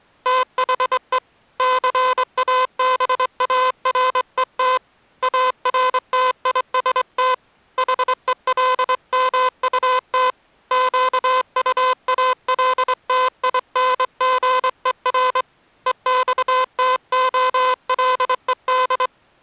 Morse code, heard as a buzzer, hand-sent with a straight key, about 23 wpm. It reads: THE CABARET ARTIST HELMUT QUALTINGER EXTOLED